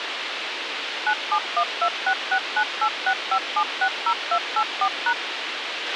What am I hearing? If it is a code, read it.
DTMF, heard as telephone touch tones, dialled by machine, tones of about 70 ms, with radio hiss and a squelch burst at the end. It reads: 9712669865760284#